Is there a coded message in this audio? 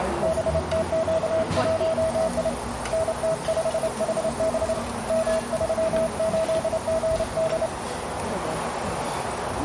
Yes: Morse code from 0.2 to 7.7 s, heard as a keyed tone, hand-sent with a straight key, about 28 wpm, 650 Hz, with radio static, a narrow filter and the noise of a restaurant. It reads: BTQ1I NT5HB M38GD